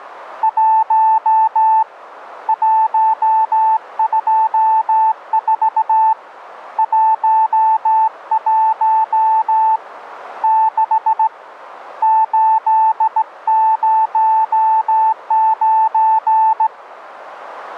Morse code, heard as a keyed tone, hand-sent with a straight key, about 17 wpm, 880 Hz, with radio static. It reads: 1 124 11 6 809